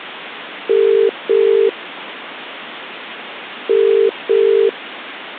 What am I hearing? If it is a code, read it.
Telephone call progress tone (as in the UK, Ireland, Australia and similar networks), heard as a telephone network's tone, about 400, 450 Hz. Ringback tone.